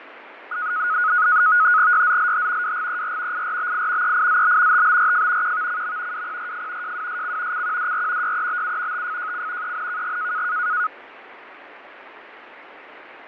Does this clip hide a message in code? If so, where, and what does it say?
Yes: NAVTEX (SITOR-B), 100 baud, 170 Hz shift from 0.5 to 10.9 s, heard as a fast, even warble, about 1360 Hz centre, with radio static and fading. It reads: YZLH WGER IRBI EIZB TBRF QVCM WPRF JWSC CQDR YEBU TFJC ENKG